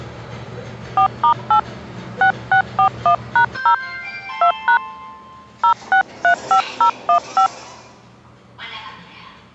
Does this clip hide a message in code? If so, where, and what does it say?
Yes: DTMF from 1.0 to 7.5 s, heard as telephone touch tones, dialled by hand, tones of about 90 ms, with the noise inside a lift. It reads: 4*8 6641#0 2# 0635015